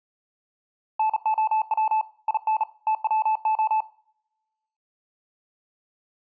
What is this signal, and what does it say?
Morse code, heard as a keyed tone, hand-sent with a bug key, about 38 wpm, 870 Hz. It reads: NOW IN TWO